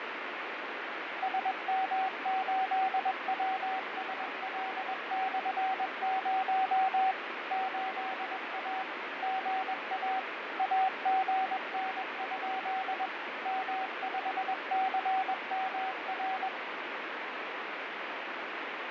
Morse code, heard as a keyed tone, machine-sent, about 21 wpm, 760 Hz, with heavy radio static and fading. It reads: SM8WSL/0 8A GA AGN? M5CMR